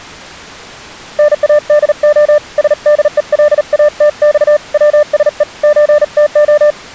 Morse code (Russian alphabet), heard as a keyed tone, hand-sent with a paddle, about 38 wpm, 600 Hz. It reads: НАДО СДЕЛАТЬ ВСЕ ЧТО